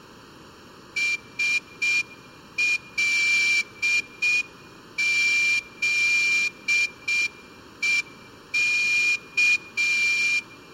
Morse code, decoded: SLZEK

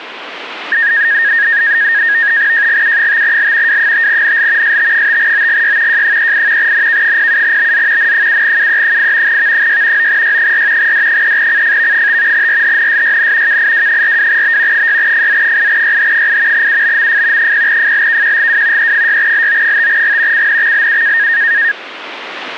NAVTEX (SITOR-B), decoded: JGU5L W5NL ST5OGY J38 NK07BZ N7UE8 V6 9Y4 D3CFV5 RHNSYN KIW42B 6FZ8YH8 UBMF 0FLKQGW E6LO5G CNXLU

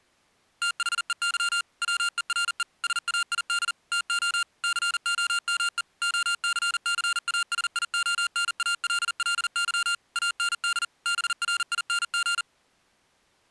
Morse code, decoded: THEY WERE SAID TO COME OCCASIONALLY AND BRING

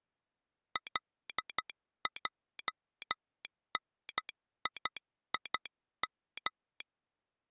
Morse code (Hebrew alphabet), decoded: לעניים

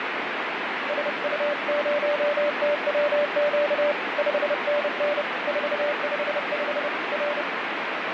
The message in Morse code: SU0TWQ 5NN 455 R

